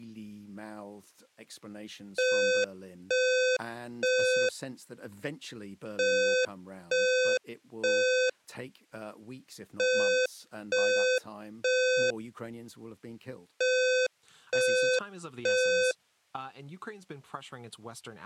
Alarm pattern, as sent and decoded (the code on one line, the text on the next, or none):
3 beeps and a pause
temporal three